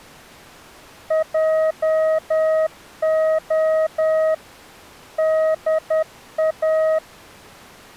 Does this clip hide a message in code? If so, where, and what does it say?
Yes: Morse code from 1.0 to 7.0 s, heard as a keyed tone, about 10 wpm, 630 Hz. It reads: JO DA